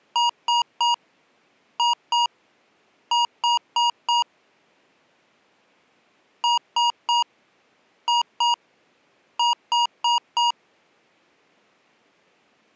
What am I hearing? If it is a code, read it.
Beep code, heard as beeps from a small speaker, played twice, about 950 Hz. 3-2-4. In Phoenix BIOS tables: keyboard controller failure.